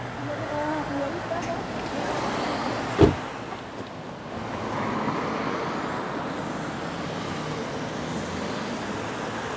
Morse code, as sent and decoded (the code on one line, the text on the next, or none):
none